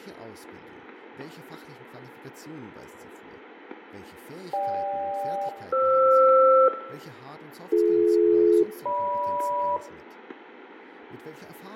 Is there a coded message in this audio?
Yes: aircraft SELCAL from 4.5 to 9.8 s, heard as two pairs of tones, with radio static, fading, static crashes, room echo and speech in German. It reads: GK-FR BD-GM